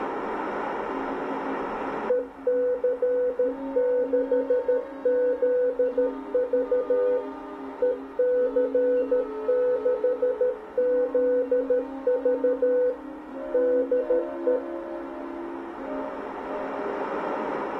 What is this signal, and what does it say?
Morse code, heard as a keyed tone, machine-sent, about 13 wpm, 500 Hz. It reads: EC6ZV EC6ZV DE